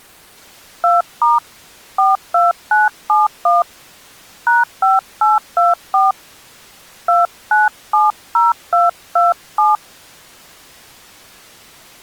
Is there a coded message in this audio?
Yes: DTMF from 0.8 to 9.8 s, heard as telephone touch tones, dialled by hand, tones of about 170 ms. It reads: 2* 42971 #5824 2970227